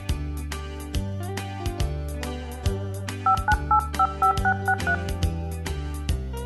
DTMF, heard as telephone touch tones, dialled by hand, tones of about 80 ms, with room echo. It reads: 59855663